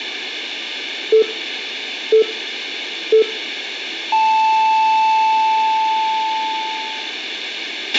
Radio time signal (three low pips and a long one an octave up, as on NHK), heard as pips, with a squelch burst at the end and room echo.